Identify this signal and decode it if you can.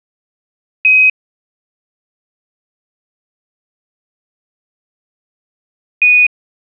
Quindar tones, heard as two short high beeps.